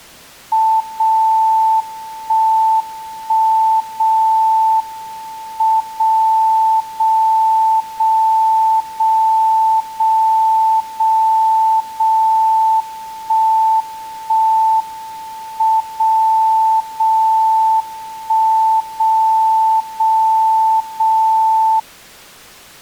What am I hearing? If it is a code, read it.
Radio time signal (WWVB), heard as a tone whose level steps once a second, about 880 Hz. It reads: 0 1 1 0 M 0 0 0 0 0 0 0 1 1 M 0 0 1 0 0 0